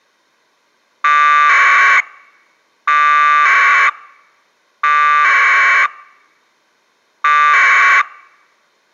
Packet radio (AX.25, as in APRS), 1200 baud, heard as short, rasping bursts.